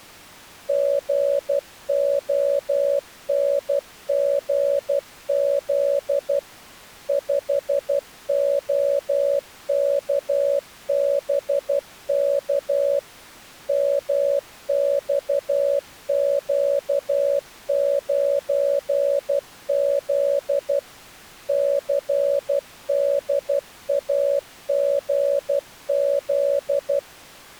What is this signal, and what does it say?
Morse code, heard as a keyed tone, machine-sent, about 12 wpm, 560 Hz. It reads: GONGZ 5OKBK MXQ9Z CDAGZ